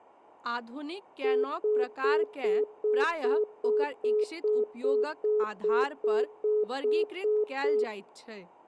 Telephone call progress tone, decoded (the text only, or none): congestion tone